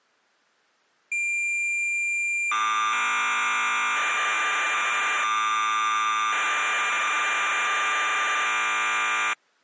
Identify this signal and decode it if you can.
Cassette data (Kansas City type), 1200 baud, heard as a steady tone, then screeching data.